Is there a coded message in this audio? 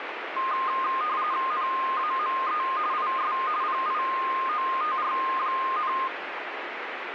Yes: RTTY (45.45 baud, 170 Hz shift) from 0.4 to 6.1 s, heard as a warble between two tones, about 1140 Hz centre, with radio static. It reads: NAME IS PIOTR,